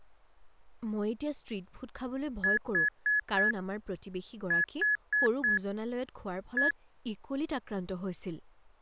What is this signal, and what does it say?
Beep code, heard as beeps, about 1700 Hz, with speech in Assamese. 4-4-1. In Phoenix BIOS tables: serial port failure.